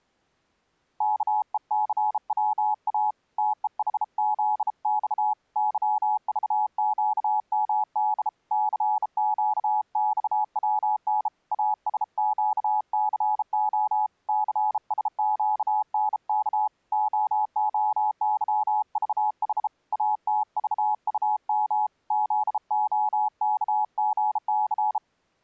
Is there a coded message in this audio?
Yes: Morse code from 0.9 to 25.0 s, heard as a keyed tone, hand-sent with a bug key, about 33 wpm, 850 Hz. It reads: KECWA TEHZX YVQMD CQXWN ASQCO CSQNK OOYVH ATVUM ZOKGC